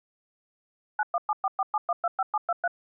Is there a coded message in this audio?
Yes: DTMF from 1.0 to 2.7 s, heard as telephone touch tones, dialled by machine, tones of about 40 ms. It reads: 917447125723